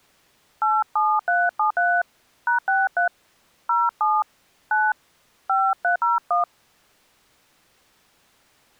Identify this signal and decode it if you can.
DTMF, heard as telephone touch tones, dialled by hand, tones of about 190 ms. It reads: 87373 #63 07 9 5301